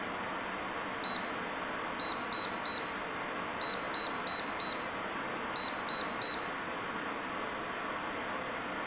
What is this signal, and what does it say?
Beep code, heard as a piezo beeper, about 3900 Hz, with room echo. 1-3-4-3. In Phoenix BIOS tables: memory failure on data bits.